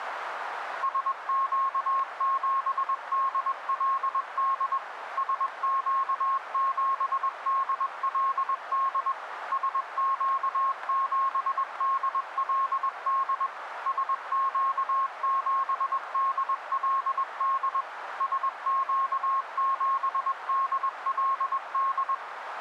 Morse code, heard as a keyed tone, machine-sent, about 21 wpm, 1080 Hz, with radio static and a narrow filter. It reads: SQ7DLD SQ7DLD SQ7DLD SQ7DLD SQ7DLD